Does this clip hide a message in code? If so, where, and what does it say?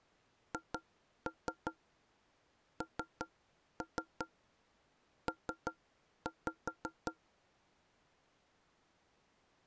Yes: tap code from 0.5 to 7.2 s, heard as knocks on wood, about 5 knocks a second. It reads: HNP